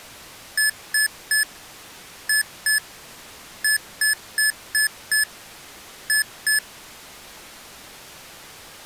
Beep code, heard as beeps from a small speaker, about 1700 Hz. 3-2-5-2.